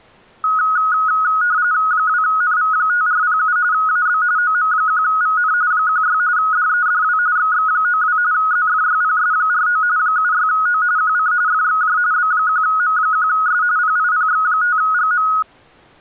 RTTY (45.45 baud, 170 Hz shift), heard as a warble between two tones, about 1360 Hz centre. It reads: 2NV5407 AB OM1VN 16 DEDW XX92 ZFYPS49 76O QC FXJ B1M1S PIPX5GM